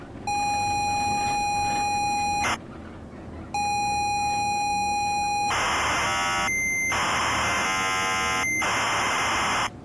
ZX Spectrum tape loading, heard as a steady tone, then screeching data, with the noise inside a bus.